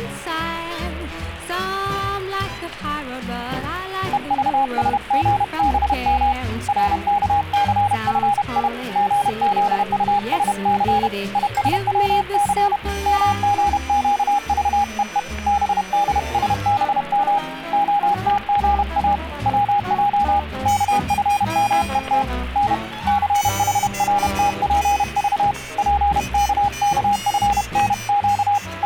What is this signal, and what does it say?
Morse code, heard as a keyed tone, hand-sent with a paddle, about 31 wpm, 820 Hz, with static crashes. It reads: EVSGBM RKCFI GZUSC ISWC MGQVEE BDSBM OTGA WJ KFMET N CHRTPV PKKFNQ …